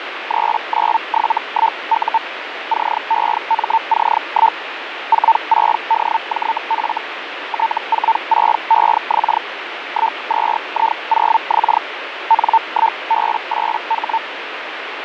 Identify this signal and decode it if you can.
Hellschreiber (Feld-Hell, 122.5 baud), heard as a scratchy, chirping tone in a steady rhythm, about 900 Hz, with radio static. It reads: 3971U CEMC1 46DJF T46EX 12I0X N1B8H